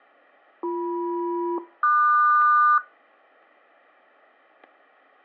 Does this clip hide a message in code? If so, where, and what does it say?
Yes: aircraft SELCAL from 0.6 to 2.8 s, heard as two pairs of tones, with static crashes. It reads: BM-QS